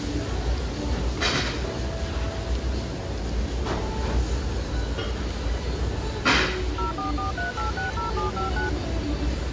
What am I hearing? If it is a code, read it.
DTMF, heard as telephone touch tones, dialled by machine, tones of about 130 ms, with the noise of a restaurant. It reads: 0443860759